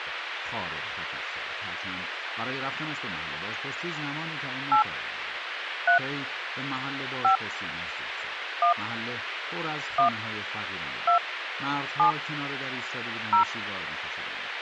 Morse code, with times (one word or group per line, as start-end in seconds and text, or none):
none